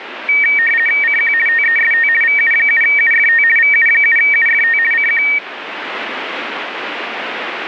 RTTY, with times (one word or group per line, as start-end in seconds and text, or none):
1.0-1.3 CQ
1.5-2.1 TEST
2.2-3.4 VU7UFT
3.6-4.8 VU7UFT
4.9-5.2 CQ